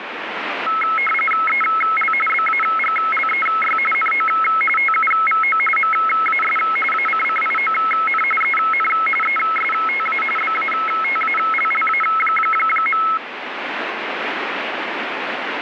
RTTY (45.45 baud, 850 Hz shift), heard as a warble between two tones, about 1750 Hz centre, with radio static. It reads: EL BAGLEY NO TUVO MAS ACCION EN ESTA BATALLA.